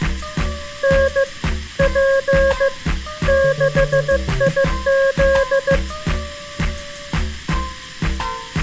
Morse code, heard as a keyed tone, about 15 wpm, 540 Hz. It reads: N P 6IZ